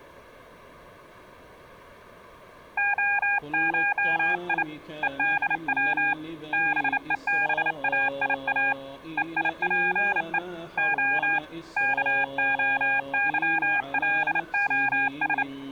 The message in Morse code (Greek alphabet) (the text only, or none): ΟΧΙ ΕΔΩ ΒΕΒΑΙΑ ΕΙΠΕ Ο ΚΟΥΛΟΣ